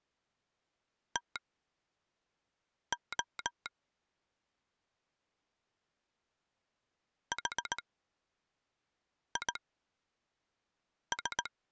Morse code, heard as a telegraph sounder, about 18 wpm, spaced as for 5 wpm. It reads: TO HIS